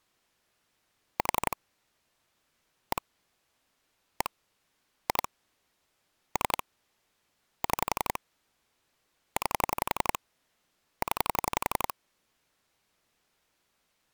Pulse dialling, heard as clicks on a phone line, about 11 pulses a second. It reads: 4 1 1 2 3 6 9 0